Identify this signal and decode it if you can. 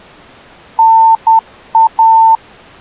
Morse code (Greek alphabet), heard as a keyed tone, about 10 wpm, 900 Hz. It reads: ΝΑ